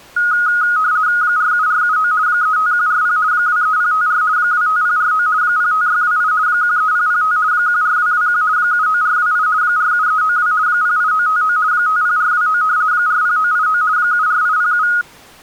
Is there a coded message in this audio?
Yes: RTTY (50 baud, 170 Hz shift) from 0.2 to 15.0 s, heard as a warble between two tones, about 1350 Hz centre. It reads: 47479 35140 23054 25049 05628 13005 14221 79428 47392 08959 50429 40989 74807